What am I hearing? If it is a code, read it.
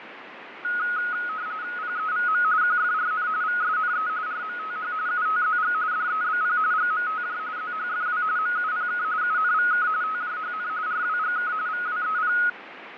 RTTY (45.45 baud, 170 Hz shift), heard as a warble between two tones, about 1360 Hz centre, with radio static and fading. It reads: PEVM QFRN VSNE RMTH UTZG DEBP GMTJ ZHFW MUPK UNVK TJHN RWGK VWEP